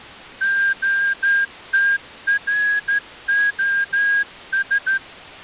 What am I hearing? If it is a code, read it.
Morse code, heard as a whistle, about 13 wpm. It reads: OTROS